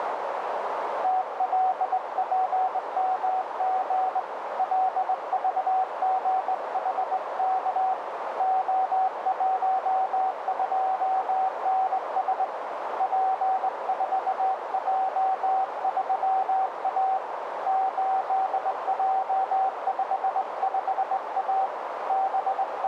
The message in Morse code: TLPMG LVGHK O12NS P4J3A 8J55A …

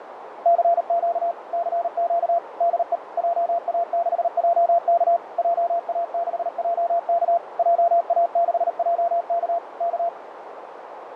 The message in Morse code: CQ CQ DE JA6JK JA6JK JA6JK K

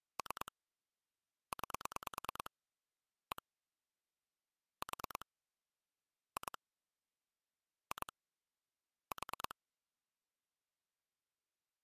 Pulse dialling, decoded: 3 9 1 4 2 2 4

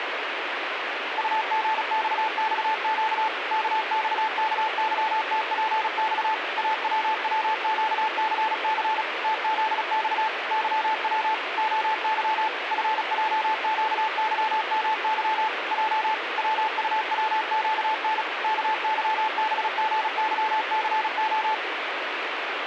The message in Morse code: UGXXQ KXKYTPX AWWQCC TZX YW OY FJQYMY J WUWQN KYBGYCO

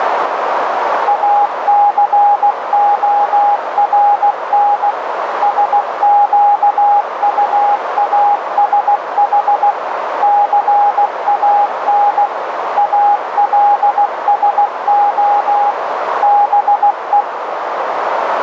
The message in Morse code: ACORN SQUASH CAN ALSO BE

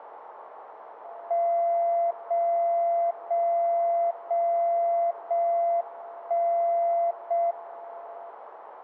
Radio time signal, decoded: 0 0 0 0 1 0 M

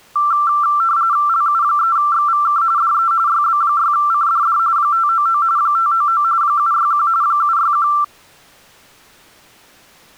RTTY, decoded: LU3XVK DE YB6CDD 599 599 761 761

